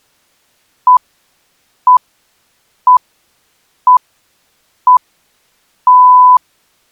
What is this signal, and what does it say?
Radio time signal (six pips, as the Greenwich Time Signal), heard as pips.